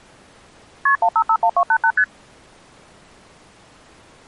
Multi-frequency trunk signalling (R1, as on North American trunks), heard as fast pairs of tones, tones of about 70 ms. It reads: KP 1551288 ST